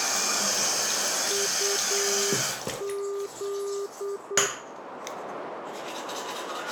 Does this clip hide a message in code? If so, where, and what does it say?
Yes: Morse code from 1.2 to 4.5 s, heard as a keyed tone, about 8 wpm, 400 Hz, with radio static, a narrow filter and the noise of a restroom. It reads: UZ